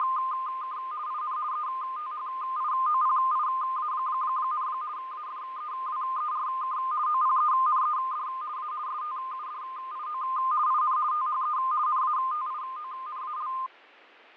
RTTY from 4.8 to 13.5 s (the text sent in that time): AFEWERK OPENED A STUDIO IN THE NATIONAL